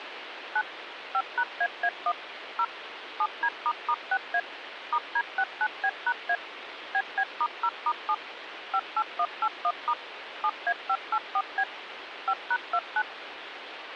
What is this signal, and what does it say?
DTMF, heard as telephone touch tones, dialled by machine, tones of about 60 ms, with phone line noise. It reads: 9 5#AA1 0 7D**6A *D69B#A BB*0*7 58181* 7A584B 5#29